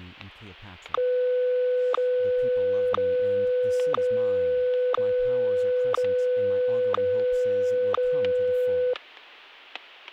Radio time signal (WWVH, Hawaii), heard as ticks, one a second, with static crashes and speech in English.